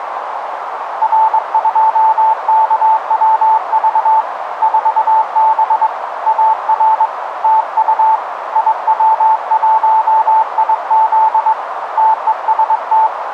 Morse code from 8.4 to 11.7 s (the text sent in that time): IW1IZ